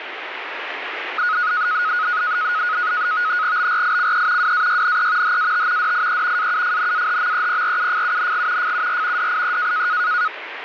NAVTEX (SITOR-B), 100 baud, 170 Hz shift, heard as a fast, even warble, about 1360 Hz centre, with radio static. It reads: BRICE WAYNE HAT DIE AUFNAHMEPRUFUNG FUR DIE